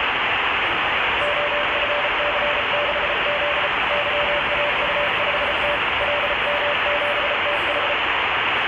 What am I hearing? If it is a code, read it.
Morse code, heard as a keyed tone, hand-sent with a paddle, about 34 wpm, 580 Hz, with heavy radio static and the noise of a residential street. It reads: OFC6Z YAU5T LM7TH